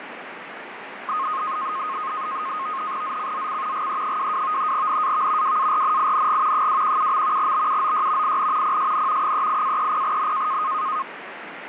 NAVTEX (SITOR-B), 100 baud, 170 Hz shift, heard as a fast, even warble, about 1160 Hz centre, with radio static and fading. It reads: ZCZC GE22 NAV WARNING 217. BUOY IN PSN 38-30N